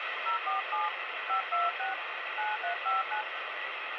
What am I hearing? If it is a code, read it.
DTMF, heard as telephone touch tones, dialled by hand, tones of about 140 ms, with radio hiss. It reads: 047 526 9359